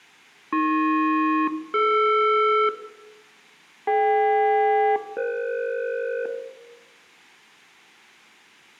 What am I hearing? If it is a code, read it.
Aircraft SELCAL, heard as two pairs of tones, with room echo. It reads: AP-DR DK-EF